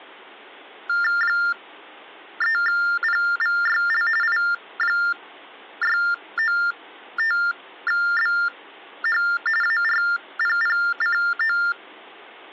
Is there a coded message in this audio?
Yes: TTY/TDD text telephone tones (45.45 baud Baudot) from 0.9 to 11.7 s, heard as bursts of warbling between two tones, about 400 Hz shift, 1600 Hz centre. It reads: 3PVYL I695BH ARPPCO